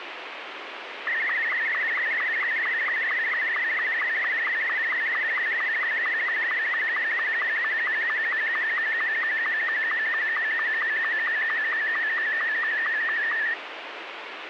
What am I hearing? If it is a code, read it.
SSTV (slow-scan television), Martin M2, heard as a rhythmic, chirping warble, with radio hiss.